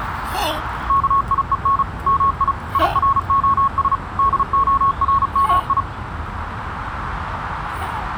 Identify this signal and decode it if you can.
Morse code, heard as a keyed tone, machine-sent, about 35 wpm, 1100 Hz, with radio static and the noise of a park. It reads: KIEN MI IROS DORMI